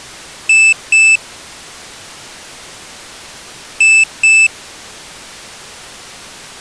Beep code, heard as a piezo beeper, played twice, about 2650 Hz. 2 short. In AMI BIOS tables: memory parity error; in IBM BIOS tables: self-test error shown on screen; in Dell tables: no memory detected.